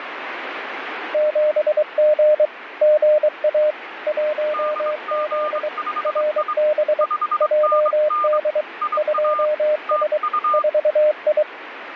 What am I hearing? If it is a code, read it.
Morse code, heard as two keyed tones, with radio static. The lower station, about 23 wpm, 610 Hz: 7G GA 1Z RB JD 2S 4I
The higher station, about 24 wpm, 1200 Hz: DG5I 5NN IA TU